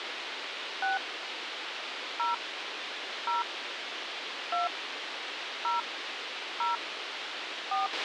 DTMF, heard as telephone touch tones, dialled by hand, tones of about 150 ms, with radio hiss and a squelch burst at the end. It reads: 6 0 0 2 0 0 4